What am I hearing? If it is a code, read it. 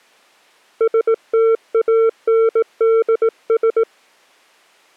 Morse code, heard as a keyed tone, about 18 wpm, 450 Hz. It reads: STANDS